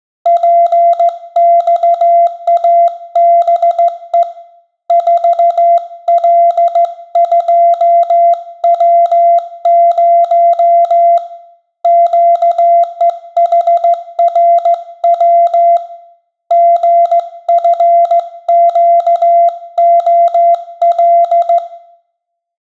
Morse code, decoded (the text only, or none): PXABE 4L2W0 QEHRW GFQOL